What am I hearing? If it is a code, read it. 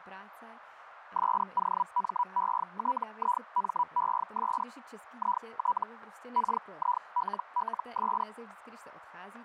Hellschreiber (Feld-Hell, 122.5 baud), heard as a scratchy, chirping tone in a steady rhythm, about 980 Hz, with radio static and speech in Czech. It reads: SOMETIMES IT KILLS